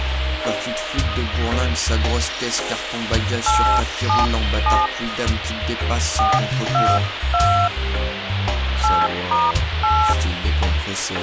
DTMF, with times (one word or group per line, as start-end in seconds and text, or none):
3.5-4.9 877
6.2-7.7 422
8.8-10.1 8*8